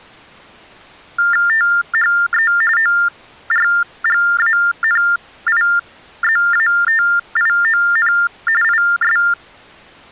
TTY/TDD text telephone tones (45.45 baud Baudot), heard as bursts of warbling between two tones, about 400 Hz shift, 1600 Hz centre. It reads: THE ORGANIZATION IS